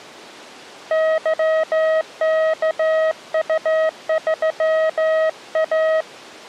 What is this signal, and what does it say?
Morse code, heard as a keyed tone, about 15 wpm, 640 Hz. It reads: YKU3A